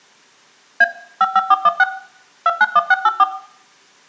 DTMF, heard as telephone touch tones, dialled by machine, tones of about 40 ms, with room echo. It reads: A 55416 291684